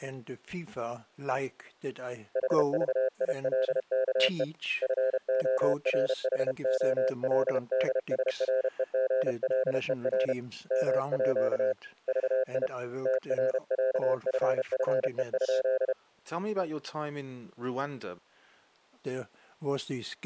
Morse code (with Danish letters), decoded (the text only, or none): HVILKE FORHOLDSREGLER MÅ VI TRÆFFE?